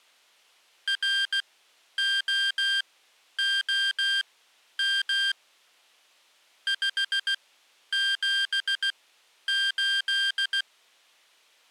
Morse code, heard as electronic beeps, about 16 wpm, spaced as for 10 wpm, 1600 Hz. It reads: ROOM 578